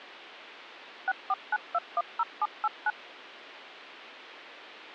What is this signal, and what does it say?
DTMF, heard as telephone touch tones, dialled by machine, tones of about 40 ms. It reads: 649210789